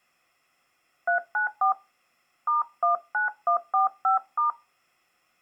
DTMF, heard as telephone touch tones, dialled by hand, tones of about 120 ms. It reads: 394 *19145*